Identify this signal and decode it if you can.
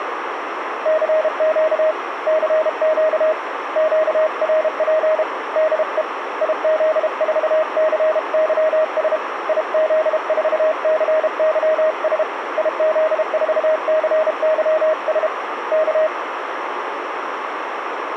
Morse code, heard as a keyed tone, hand-sent with a paddle, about 32 wpm, 630 Hz, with radio static and a narrow filter. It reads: CQ CQ QRP DE IZ4CYS IZ4CYS IZ4CYS K